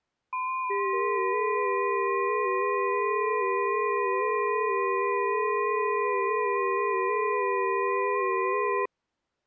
FT8 (several signals at once), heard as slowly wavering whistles, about 6.25 baud.